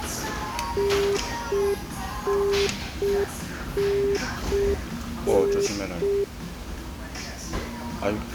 Telephone call progress tone (UK plan), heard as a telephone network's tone, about 400 Hz, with the noise of a restaurant. Congestion tone.